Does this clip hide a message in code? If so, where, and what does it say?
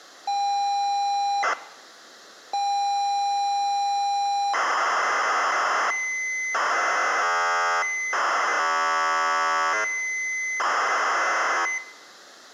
Yes: ZX Spectrum tape loading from 0.3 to 11.8 s, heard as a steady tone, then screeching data.